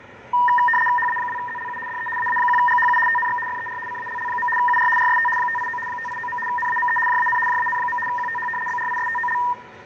RTTY (75 baud, 850 Hz shift), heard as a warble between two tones, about 1400 Hz centre, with radio static, fading, room echo and the noise of a crowd indoors. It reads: HA2ZLU DE AA1GHU TNX FER CALL. UR RST 589 589. NAME JAN JAN. QTH BRISTOL